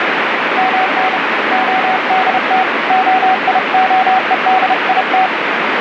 Morse code (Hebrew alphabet), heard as a keyed tone, hand-sent with a paddle, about 31 wpm, 750 Hz, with heavy radio static. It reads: מן הדת היהודית